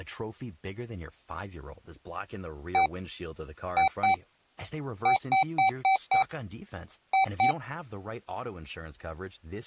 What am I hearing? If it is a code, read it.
Beep code, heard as beeps from a small speaker, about 770 Hz, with speech in English. 1-2-5-2.